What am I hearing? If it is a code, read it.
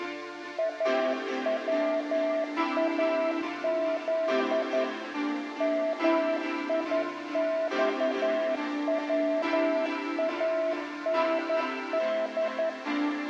Morse code (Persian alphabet), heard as a keyed tone, machine-sent, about 11 wpm, 650 Hz, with room echo. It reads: اواز میخواند